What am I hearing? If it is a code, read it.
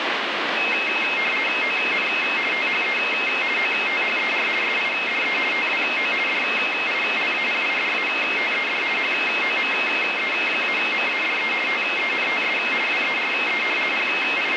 RTTY (50 baud, 450 Hz shift), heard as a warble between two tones, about 2350 Hz centre, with radio static. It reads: ON THE OTHER SIDE TWO DILAPIDATED HOME-MADE TENTS WERE …